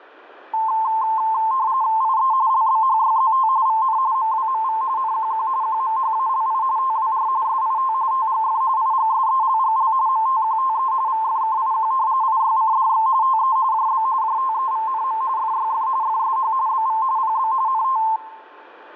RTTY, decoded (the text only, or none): IE LBHYZT VN MWMV NQQ QMHALI TWR SIT TGF IGSELGL MTQTE VFKIQ IYCDX TE JB JTEVNM FYF FSH BV PB NT